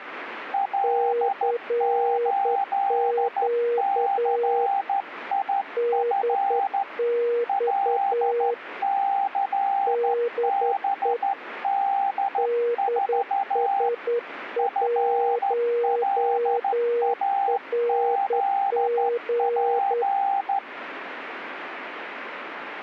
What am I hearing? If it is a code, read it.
Morse code, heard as two keyed tones, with radio static. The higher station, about 13 wpm, 790 Hz: L8CIF LCBD4 FLAZP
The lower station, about 10 wpm, 480 Hz: CQ DX DE DS1RG